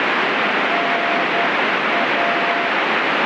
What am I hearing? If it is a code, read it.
Morse code, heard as a keyed tone, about 10 wpm, 690 Hz, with heavy radio static. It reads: NA